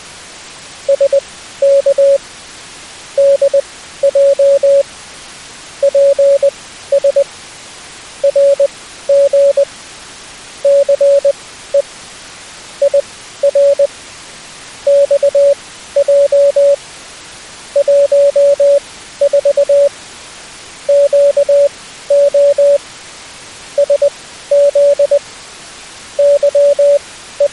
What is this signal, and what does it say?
Morse code, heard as a keyed tone, machine-sent, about 20 wpm, spaced as for 13 wpm, 560 Hz. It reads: SK DJ PS RG CE IR XJ 14 QO SZ …